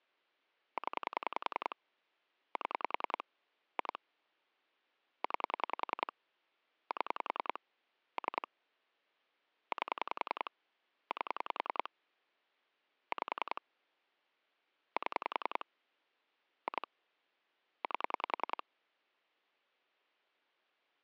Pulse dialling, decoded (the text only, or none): 0 7 2 9 7 3 8 8 5 7 2 8